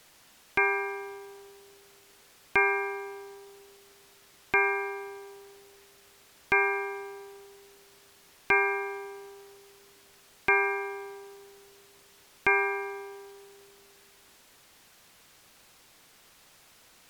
Clock strike, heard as a bell. 7. Seven o'clock.